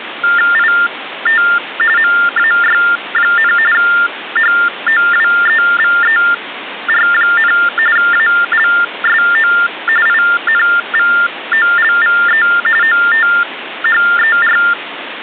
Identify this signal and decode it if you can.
TTY/TDD text telephone tones (45.45 baud Baudot), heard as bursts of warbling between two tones, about 400 Hz shift, 1600 Hz centre, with phone line noise. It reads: IT MAY, HOWEVER, ALSO INVOLVE OTHER